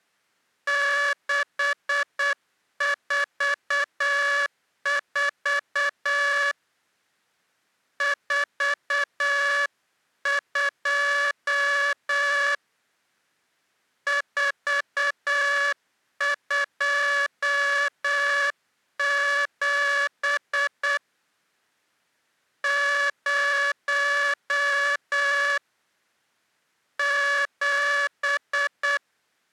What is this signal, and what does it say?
Morse code, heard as a buzzer, hand-sent with a paddle, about 8 wpm. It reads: 644 42 427 0 7